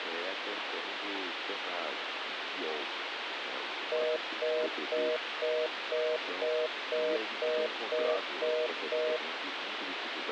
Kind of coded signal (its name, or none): telephone call progress tone